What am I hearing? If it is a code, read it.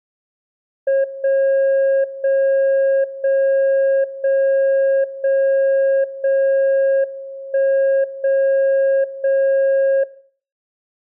Radio time signal (WWVB), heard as a tone whose level steps once a second, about 540 Hz. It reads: 0 0 0 0 0 0 1 0 0